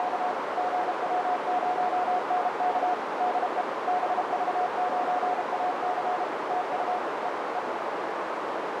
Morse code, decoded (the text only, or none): … GW0NK DE BV9AC TU E E